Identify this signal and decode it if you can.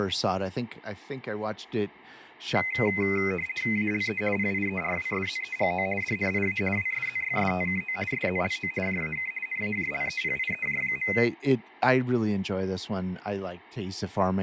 RTTY (50 baud, 450 Hz shift), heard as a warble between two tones, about 2250 Hz centre, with room echo and speech in English. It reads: ALE PIERWSZEGO DNIA WSZYSTKO SZLO JAK NAJLEPIEJ.